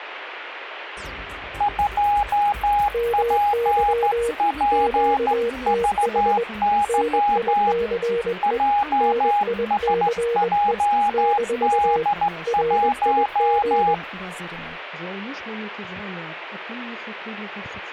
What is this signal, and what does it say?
Morse code, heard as two keyed tones, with radio static. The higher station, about 14 wpm, 820 Hz: 2PPVY JSJD1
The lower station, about 21 wpm, 470 Hz: MY QTH NICE NICE - RIG